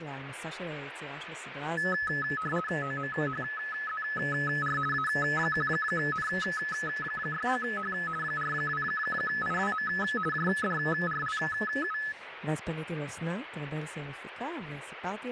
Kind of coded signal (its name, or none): RTTY